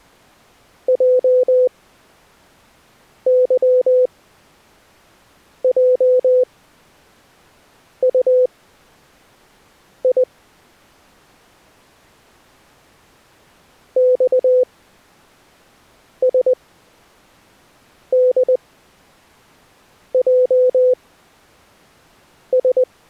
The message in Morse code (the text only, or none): JYJUI XSDJS